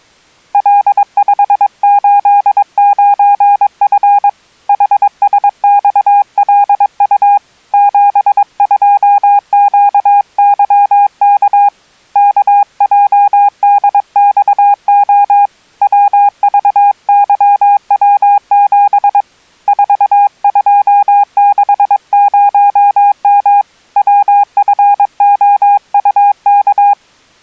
Morse code, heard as a keyed tone, hand-sent with a paddle, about 22 wpm, 810 Hz. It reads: L589F HSXLU 72QYK KJDXO WVYW7 4260M WFOUK